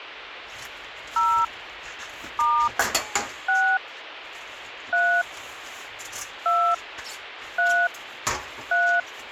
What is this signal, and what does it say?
DTMF, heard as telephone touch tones, dialled by hand, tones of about 290 ms, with radio hiss, a squelch burst at the end and kitchen noise. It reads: 0 * 6 3 2 3 3